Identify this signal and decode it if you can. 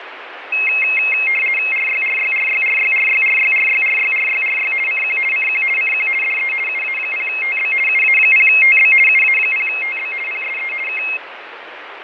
RTTY (50 baud, 450 Hz shift), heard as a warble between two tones, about 2350 Hz centre, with radio static and fading. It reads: RYRYRYRYRYRYRYRYRYRY CQ CQ CQ DE UA0TB UA0TB UA0TB PSE K